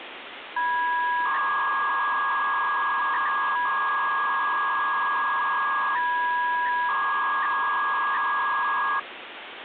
300-baud modem data (V.21 tones), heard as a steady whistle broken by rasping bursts, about 300 baud, 200 Hz shift, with phone line noise.